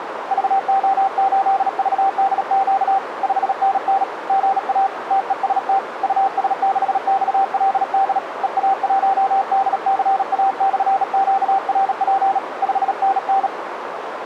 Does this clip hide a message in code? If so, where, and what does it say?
Yes: Morse code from 0.3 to 13.5 s, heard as a keyed tone, hand-sent with a bug key, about 37 wpm, 780 Hz, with radio static and a narrow filter. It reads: VO8VDQ 5NN GA TEST US6XLD EA1DCA/QRP 5NN